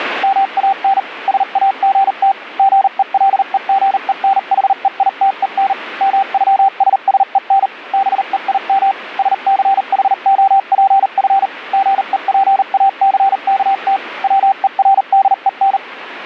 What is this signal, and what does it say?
Morse code (with German letters), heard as a keyed tone, machine-sent, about 39 wpm, spaced as for 35 wpm, 780 Hz, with radio static. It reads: MAN SAGT GELEGENHEITEN MÜSSEN BEIM SCHOPF GEPACKT WERDEN